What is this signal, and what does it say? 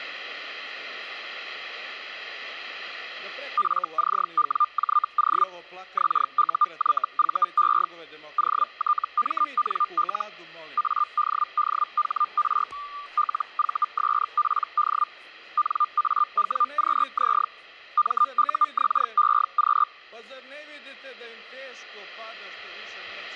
Hellschreiber (Feld-Hell, 122.5 baud), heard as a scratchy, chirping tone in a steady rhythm, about 1200 Hz. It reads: FCWJO XUYVE OTMNL ADDHR LVSPD NAWQZ MUXEQ